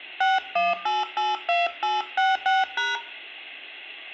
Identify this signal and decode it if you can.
DTMF, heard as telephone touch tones, dialled by hand, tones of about 180 ms, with room echo. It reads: 61882866#